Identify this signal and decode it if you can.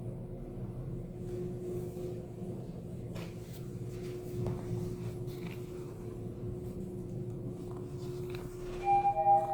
The noise inside a lift. There is no code.